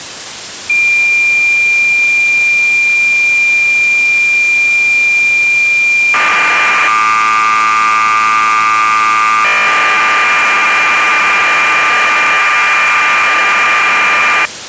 Cassette data (Kansas City type), 1200 baud, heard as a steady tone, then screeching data.